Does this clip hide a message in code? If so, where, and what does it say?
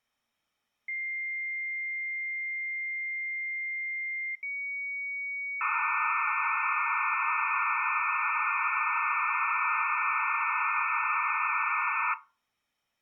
Yes: dial-up modem handshake (low-speed, two carriers) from 0.9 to 12.1 s, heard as two whistles, then hiss.